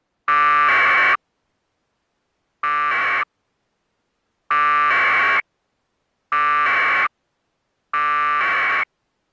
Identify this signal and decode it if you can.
Packet radio (AX.25, as in APRS), 1200 baud, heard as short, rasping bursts.